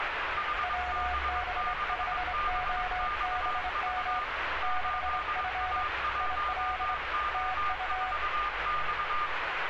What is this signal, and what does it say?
Morse code, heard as two keyed tones, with radio static and street noise. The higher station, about 22 wpm, 1210 Hz: HB6BXV 8A1O4X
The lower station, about 25 wpm, 740 Hz: WB5OBM 6F IL TU